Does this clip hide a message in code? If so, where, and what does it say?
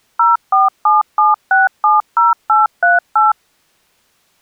Yes: DTMF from 0.2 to 3.3 s, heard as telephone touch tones, dialled by machine, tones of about 160 ms. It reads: 0477670838